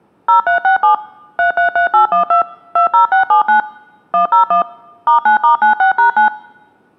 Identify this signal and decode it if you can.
DTMF, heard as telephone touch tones, dialled by machine, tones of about 120 ms. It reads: 0367 333812 20679 101 *9*96#9